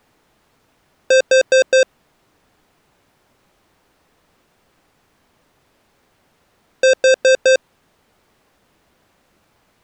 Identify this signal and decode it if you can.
Alarm pattern, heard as an alarm's beeps, played twice, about 520 Hz. Temporal four. Carbon monoxide.